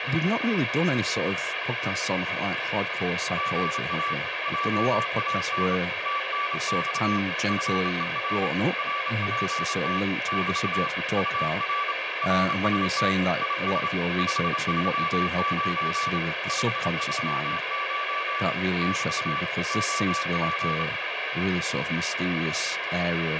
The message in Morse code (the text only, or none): GA JAN TNX FER RPT <BT> UR RST IS 539 539 <BT> OP